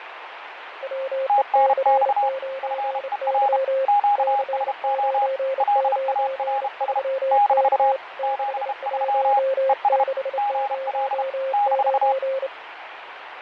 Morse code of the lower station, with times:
0.8-3.8 WEC9Y
4.2-8.0 C993K
8.2-12.5 61609

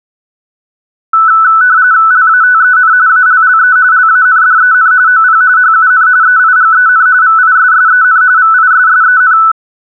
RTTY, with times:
2.1-2.9 LATEN
3.1-3.8 ALLE
3.9-4.9 LANDEN
5.1-5.4 OP
5.6-6.1 HUN
6.2-7.1 EIGEN
7.2-8.2 VISSEN
8.4-9.4 VISSEN

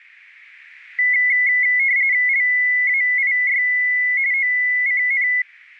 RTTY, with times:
2.3-3.6 LAIY
4.3-5.3 OCN

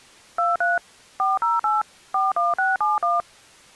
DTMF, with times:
0.4-0.8 23
1.2-1.8 408
2.1-3.2 41671

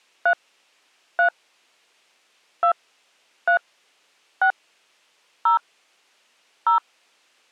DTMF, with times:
0.3-0.3 3
1.2-1.3 3
2.6-2.7 2
3.5-3.6 3
4.4-4.5 6
5.5-5.6 0
6.7-6.8 0

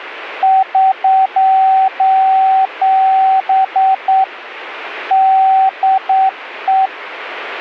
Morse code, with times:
0.4-4.2 <SOS>
5.1-6.9 DE

